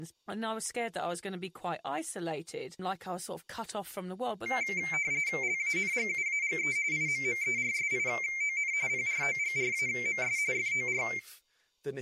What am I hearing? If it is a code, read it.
RTTY (45.45 baud, 170 Hz shift), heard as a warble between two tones, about 2200 Hz centre, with room echo and speech in English. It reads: LANGUAGE IMMERSION PROGRAMS FOR